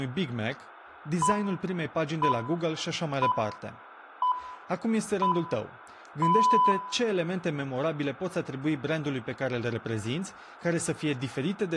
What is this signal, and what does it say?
Radio time signal (six pips, as the Greenwich Time Signal), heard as pips, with room echo and speech in Romanian.